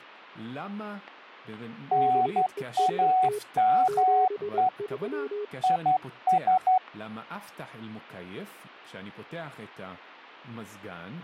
Morse code, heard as two keyed tones, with speech in Hebrew. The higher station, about 12 wpm, 740 Hz: NAME IS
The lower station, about 22 wpm, 420 Hz: BEST 73